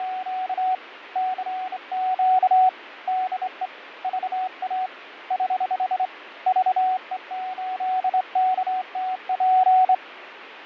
Morse code, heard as a keyed tone, hand-sent with a straight key, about 26 wpm, 750 Hz, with radio static and fading. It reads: … CQ DE VA <HH> VE8KTP